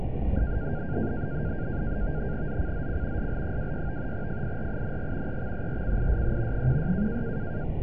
NAVTEX (SITOR-B), 100 baud, 170 Hz shift, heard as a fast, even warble, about 1500 Hz centre, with radio static. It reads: ZCZC SL26 FIRING EXERCISE 16